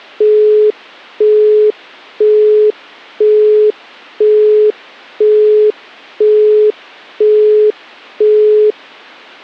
Telephone call progress tone (single-tone plan, as in Europe, Japan and elsewhere), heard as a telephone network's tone, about 420 Hz, 0.5 s on and 0.5 s off. Busy tone.